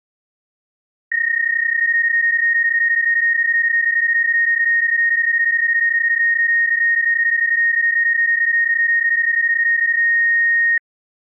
PSK31 (31.25 baud), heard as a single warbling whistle, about 1850 Hz.